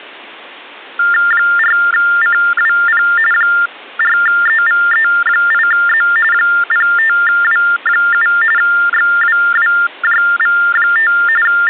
TTY/TDD text telephone tones (45.45 baud Baudot), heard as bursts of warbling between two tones, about 400 Hz shift, 1600 Hz centre. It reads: 4CWP 4EVE8Z 05W7 XWWJV5 …